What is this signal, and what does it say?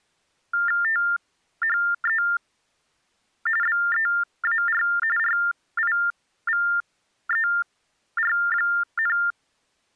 TTY/TDD text telephone tones (45.45 baud Baudot), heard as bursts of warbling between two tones, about 400 Hz shift, 1600 Hz centre. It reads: THE BEAR RIVER,